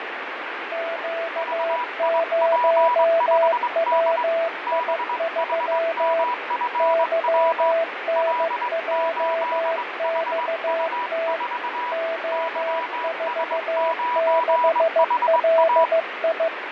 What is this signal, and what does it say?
Morse code, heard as two keyed tones, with radio static and fading. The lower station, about 15 wpm, 660 Hz: Q0WI3 YNJXT O46LI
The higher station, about 21 wpm, 980 Hz: VIP5D BHMFW L8HU4 YS9HA